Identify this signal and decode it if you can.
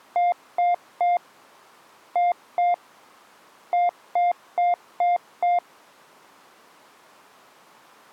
Beep code, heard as beeps, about 700 Hz. 3-2-5.